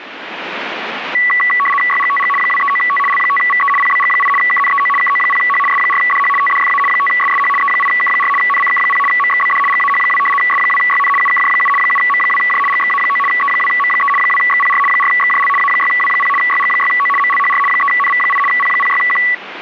RTTY (75 baud, 850 Hz shift), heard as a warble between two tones, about 1550 Hz centre, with radio static. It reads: YGTG 239T L5VE PBG8 KNEO KO0H S4DH TDFA 5SSH E8K4 NCK0 MXBD GAH2 S2YN UKJ7 7M2J GXA9 E2M3 2XPR 4XJL A6W0 YG6O MLHR 3NV8 P06Q